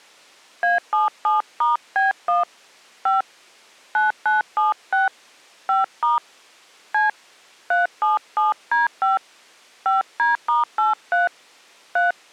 DTMF, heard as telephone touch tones, dialled by hand, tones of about 150 ms. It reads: A77*B1 5 9976 5* C 377D5 5D*83 3